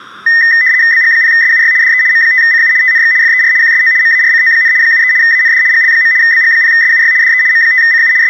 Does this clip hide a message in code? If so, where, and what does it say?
Yes: RTTY (75 baud, 170 Hz shift) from 0.3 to 8.3 s, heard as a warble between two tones, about 1900 Hz centre, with room echo. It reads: BG0SUY DE M5CU TNX FER QSO MARCO, 73 AND GL. BG0SUY DE M5CU …